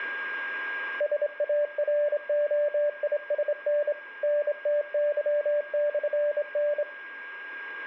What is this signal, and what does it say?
Morse code, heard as a keyed tone, hand-sent with a straight key, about 26 wpm, 590 Hz, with a steady whistle near 1620 Hz. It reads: SAROISN NTY/N